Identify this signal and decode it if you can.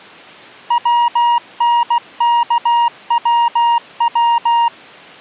Morse code, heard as a keyed tone, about 16 wpm, 940 Hz. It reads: WNKWW